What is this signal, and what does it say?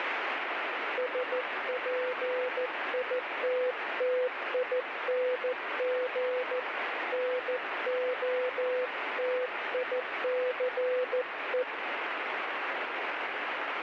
Morse code, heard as a keyed tone, hand-sent with a paddle, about 14 wpm, 500 Hz, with heavy radio static. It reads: SPITTING NOTICE